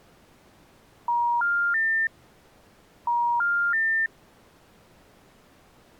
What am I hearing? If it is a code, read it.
Telephone call progress tone (ITU plan), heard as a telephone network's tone, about 950, 1400, 1800 Hz. Special information tone.